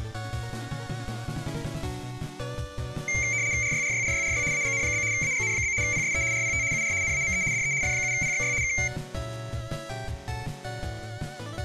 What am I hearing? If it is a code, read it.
RTTY (75 baud, 170 Hz shift), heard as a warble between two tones, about 2200 Hz centre, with room echo. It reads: RYRYRYRY AGN? AGN? PSE RPT UR NAME DE F7PXY K